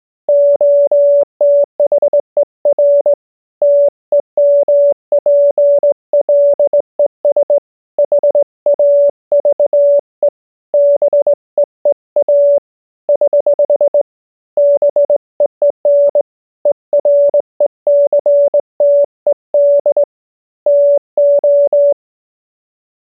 Morse code, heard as a keyed tone, hand-sent with a straight key, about 19 wpm, 570 Hz. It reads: OTHER TEMPLES HAVE BEEA <HH> BEEN ERECTED TO